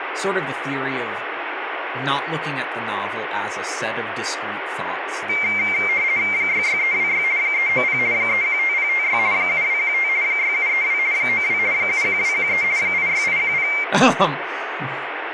RTTY (50 baud, 170 Hz shift), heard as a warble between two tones, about 2200 Hz centre, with radio static and speech in English. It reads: 66326 390 315056 7215 6732 92 71213 86810